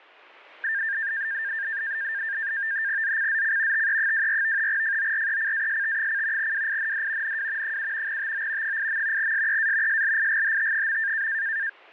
NAVTEX (SITOR-B), 100 baud, 170 Hz shift, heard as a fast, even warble, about 1700 Hz centre. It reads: ZCZC TE24 FORECAST: WIND NW 7 TO 8. SEA SLIGHT.